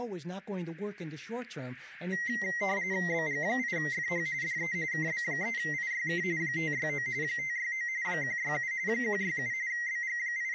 RTTY (45.45 baud, 170 Hz shift), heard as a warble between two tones, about 2000 Hz centre, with speech in English. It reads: BG8FH DE KB3IYK 569 569 167 167 …